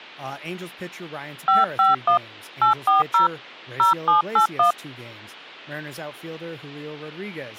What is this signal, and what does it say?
DTMF, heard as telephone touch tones, dialled by hand, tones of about 140 ms, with speech in English. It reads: 551 840 0781